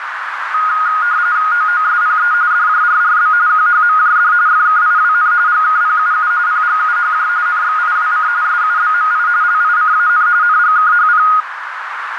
RTTY (45.45 baud, 170 Hz shift), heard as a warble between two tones, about 1340 Hz centre, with radio static and a narrow filter. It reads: OOSPE DJRRB QHMJD FKIWN GKPUU PGUHJ NXIWC SUBMI LICAN NGKHP